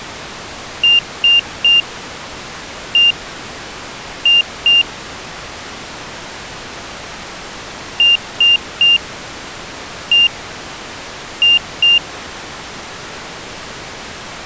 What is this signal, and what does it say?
Beep code, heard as a piezo beeper, played twice, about 2800 Hz. 3-1-2. In Phoenix BIOS tables: DMA register failure.